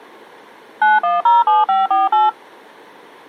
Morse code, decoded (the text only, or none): none